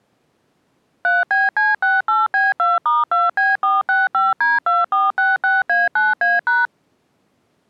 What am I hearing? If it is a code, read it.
DTMF, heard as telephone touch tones, dialled by machine, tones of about 180 ms. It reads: 3BC68B2*2B465D2466A9A#